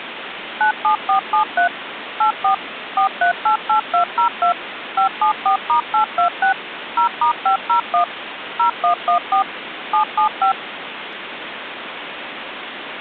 DTMF, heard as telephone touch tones, dialled by machine, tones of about 110 ms, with phone line noise. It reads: 97473 84 4388202 574*826 0*501 0114 775